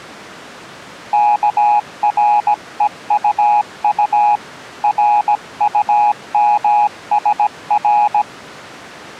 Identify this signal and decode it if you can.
Morse code, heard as a keyed tone, hand-sent with a paddle, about 17 wpm, 830 Hz. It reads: KREUU RUMSR